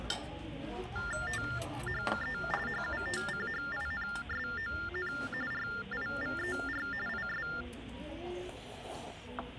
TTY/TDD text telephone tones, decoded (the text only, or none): THE HUTCHINSON RIVER IS